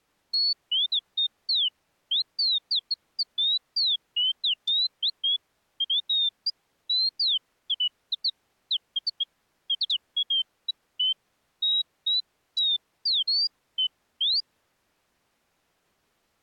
Bird-like chirps. There is no code.